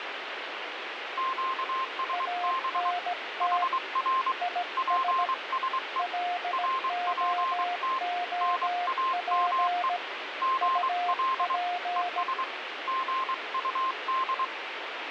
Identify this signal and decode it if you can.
Morse code, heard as two keyed tones, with radio static. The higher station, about 23 wpm, 1050 Hz: QSB HR PSE RPT NAME GL ES GUD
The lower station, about 17 wpm, 710 Hz: ANT IS LOOP UP